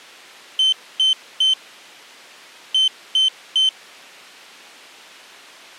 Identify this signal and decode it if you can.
Beep code, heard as a piezo beeper, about 3100 Hz. 3-3.